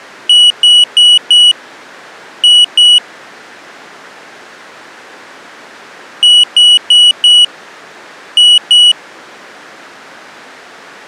Beep code, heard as a piezo beeper, played twice, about 2950 Hz. 4-2.